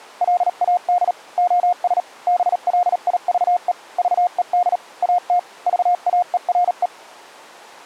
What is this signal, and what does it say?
Morse code, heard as a keyed tone, machine-sent, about 38 wpm, spaced as for 35 wpm, 710 Hz. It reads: LAD OS BLIVE VED AT VAERE